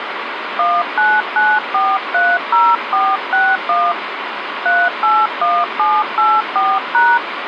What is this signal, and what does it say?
DTMF, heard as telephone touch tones, dialled by hand, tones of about 230 ms, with phone line noise. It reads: 199430461 381784#